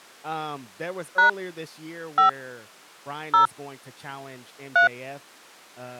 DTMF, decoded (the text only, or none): # 5 0 3